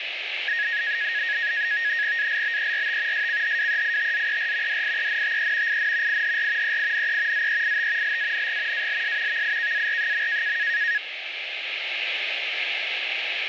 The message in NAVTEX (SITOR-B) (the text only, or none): ALBERT SCHWEITZER DIENTE IN IHR EINE ZEIT LANG ALS VIKAR.